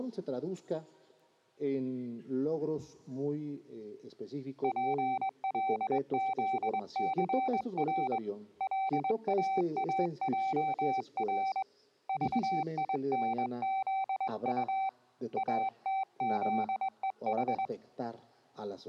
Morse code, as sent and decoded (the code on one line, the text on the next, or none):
.--. .-.. --.. -.-. .-. / .-.. .- .- .--- .-. / ...- .. -. --.. ..- / .- - --.. . ....
PLZCR LAAJR VINZU ATZEH